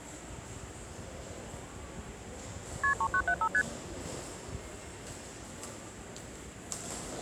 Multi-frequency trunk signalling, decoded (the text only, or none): KP 3975 ST